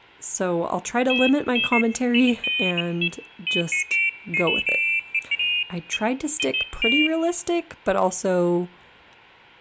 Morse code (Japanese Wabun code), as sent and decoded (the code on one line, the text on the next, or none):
none